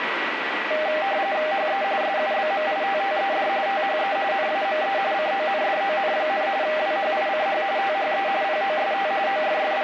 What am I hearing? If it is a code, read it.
RTTY (45.45 baud, 170 Hz shift), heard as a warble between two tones, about 700 Hz centre, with radio static and a steady whistle near 1940 Hz. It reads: HE SUBMITTED THE NAME CONDON, WHICH THE POST …